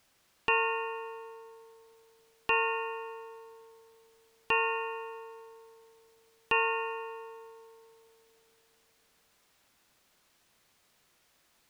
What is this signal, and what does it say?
Clock strike, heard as a bell. 4. Four o'clock.